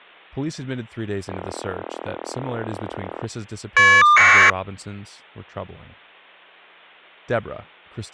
Caller ID data burst, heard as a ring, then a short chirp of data, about 1200 baud, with speech in English.